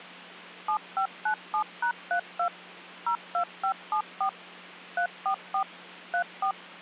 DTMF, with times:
0.7-2.5 7597#32
3.1-4.3 02574
5.0-5.6 344
6.1-6.5 34

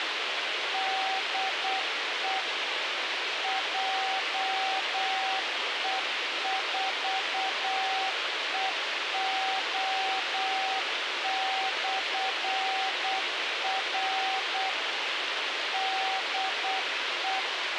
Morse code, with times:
0.7-2.4 DE
3.4-14.7 JE4EO/R
15.7-17.4 DE

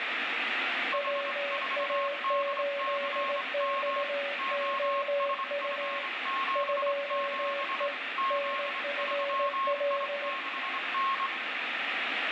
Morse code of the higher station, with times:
0.9-4.0 H4DCM
4.4-7.9 OSF77
8.2-11.3 Z3I6N

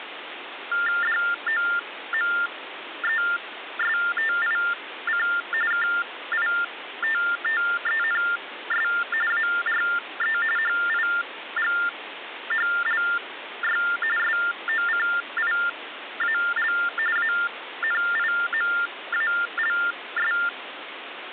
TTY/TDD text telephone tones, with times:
1.0-5.3 DOMESTIC
5.7-8.9 KITTENS
9.3-10.4 ARE
10.6-13.8 HIGHLY
14.2-16.7 SOCIAL
17.2-20.3 ANIMALS

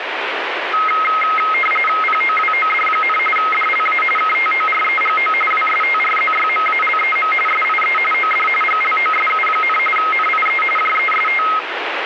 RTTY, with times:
2.0-3.2 POWOD,
3.4-4.0 DLA
4.2-5.3 KTOREGO
5.5-7.3 WSTRZYMALEM
7.5-8.0 SIE
8.1-8.5 OD
8.6-9.8 GLOSU,
10.0-10.6 NIE
10.8-11.4 JEST

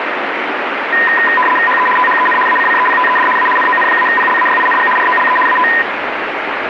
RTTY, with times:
1.7-1.9 HE
2.0-2.4 THEN
2.5-3.3 ACCEPTED
3.4-3.5 A
3.6-4.9 NON-PLAYING
5.0-5.4 ROLE
5.5-5.7 AT

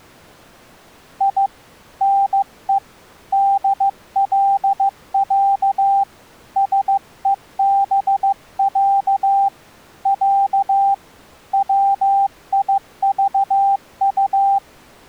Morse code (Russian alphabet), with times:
1.2-1.5 И
2.0-2.8 НЕ
3.3-6.0 ДЛЯ
6.6-9.5 СЕБЯ
10.1-10.9 Я
11.5-14.6 ВИЖУ

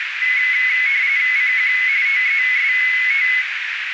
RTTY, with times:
1.4-1.7 CQ
2.1-3.3 TEST

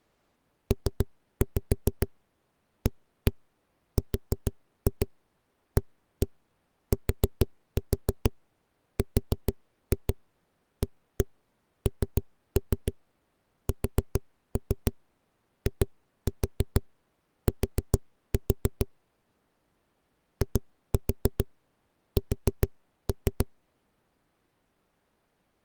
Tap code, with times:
0.7-18.9 PARATRANSIT
20.4-23.5 IS

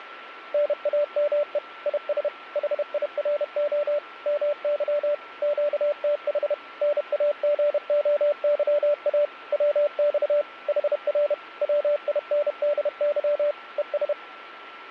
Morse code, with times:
0.5-1.6 NAME
1.9-2.3 IS
2.6-4.0 HIRO
4.3-5.1 MY
5.4-6.5 QTH
6.8-9.2 NAGOYA
9.5-10.4 WX
10.7-11.3 HR
11.6-13.5 WINDY
13.8-14.1 ES

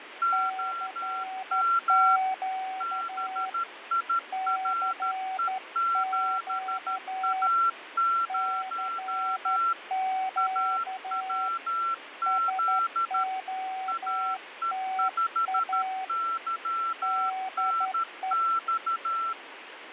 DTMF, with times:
none

